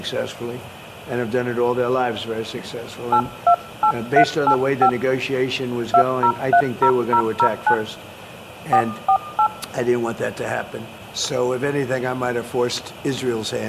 DTMF, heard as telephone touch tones, dialled by hand, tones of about 80 ms. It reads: 828385 2030009 448